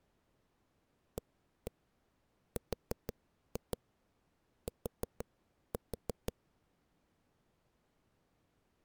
Tap code, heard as knocks on a wall, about 6 knocks a second. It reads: ART